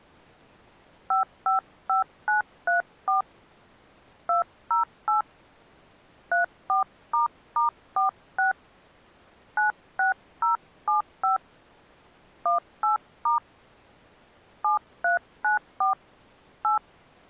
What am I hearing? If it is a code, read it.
DTMF, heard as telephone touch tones, dialled by hand, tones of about 130 ms. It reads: 555934 208 34**46 96075 18* 7394 8